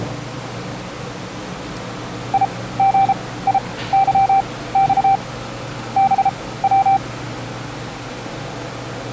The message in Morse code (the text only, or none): IGIYX BW